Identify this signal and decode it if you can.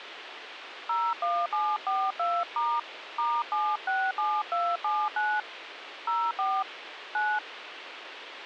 DTMF, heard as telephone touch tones, dialled by hand, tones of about 240 ms, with radio hiss and a squelch burst at the end. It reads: 01742* *767279 04 9